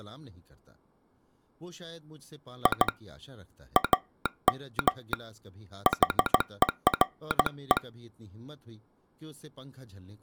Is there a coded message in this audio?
Yes: Morse code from 2.6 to 7.8 s, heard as a telegraph sounder, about 16 wpm, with speech in Urdu. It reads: I AM HERE